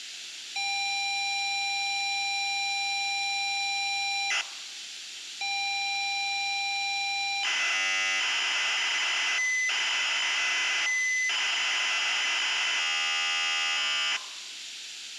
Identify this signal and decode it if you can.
ZX Spectrum tape loading, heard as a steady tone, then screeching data.